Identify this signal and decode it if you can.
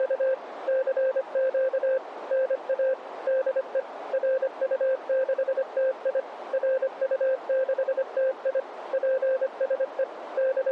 Morse code, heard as a keyed tone, machine-sent, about 25 wpm, 520 Hz, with radio static. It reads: … CQ NA DE RU6TI RU6TI PSE …